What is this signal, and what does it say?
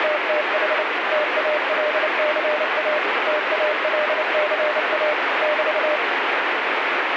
Morse code, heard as a keyed tone, machine-sent, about 29 wpm, 600 Hz, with heavy radio static. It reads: … TALCA TALCA <BT>